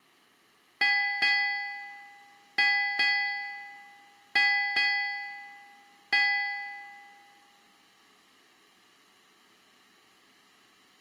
Ship's bell, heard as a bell, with room echo. 7. Seven half-hours of the watch have passed.